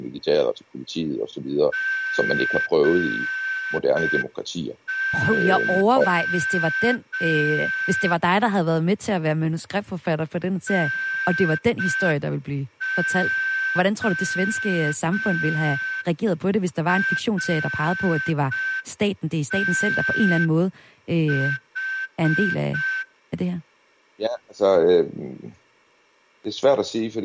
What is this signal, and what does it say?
Morse code, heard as a whistle, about 5 wpm, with speech in Danish. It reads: GO NORTH